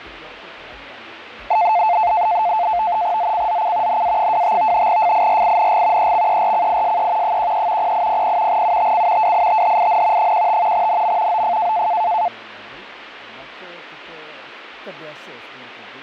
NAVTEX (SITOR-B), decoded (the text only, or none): ZCZC NA25 FIRING EXERCISE 13 0800 UTC WITHIN 15 NM OF